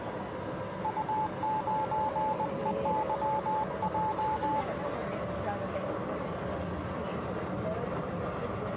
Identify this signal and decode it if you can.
Morse code, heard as a keyed tone, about 20 wpm, 870 Hz, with the noise inside a subway train. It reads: U9EYJ